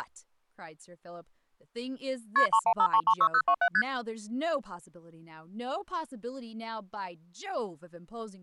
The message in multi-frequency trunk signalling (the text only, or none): KP 315336027 ST